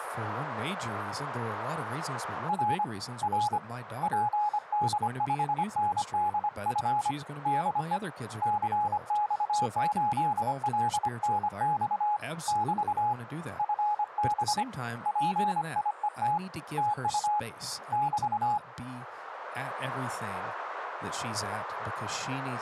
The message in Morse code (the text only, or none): R R PD5NDF DE CX8LNX <BT> FB PIET TU <BT>